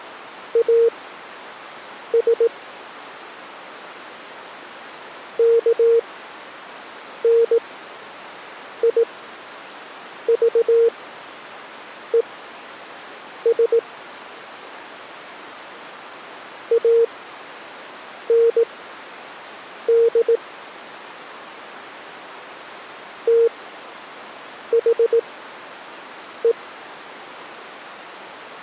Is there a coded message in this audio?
Yes: Morse code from 0.5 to 26.6 s, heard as a keyed tone, machine-sent, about 18 wpm, spaced as for 6 wpm, 460 Hz. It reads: AS KNIVES AND THE